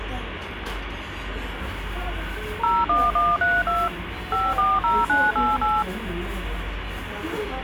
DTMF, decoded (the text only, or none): 01132 540988